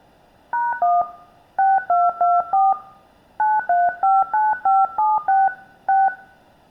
DTMF, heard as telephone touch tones, dialled by hand, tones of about 200 ms, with room echo. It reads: #1 6224 9359576 6